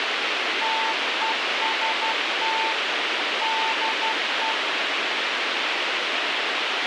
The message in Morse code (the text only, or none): TEST DE